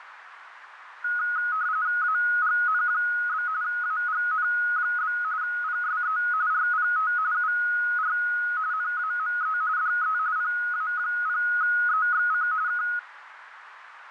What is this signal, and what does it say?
RTTY (45.45 baud, 170 Hz shift), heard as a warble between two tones, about 1360 Hz centre, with radio static. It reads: AGN? AGN? PSE RPT UR NAME DE PA0EXC K